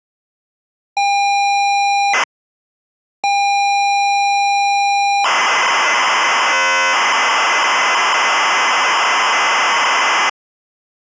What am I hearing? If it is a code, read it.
ZX Spectrum tape loading, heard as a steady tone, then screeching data.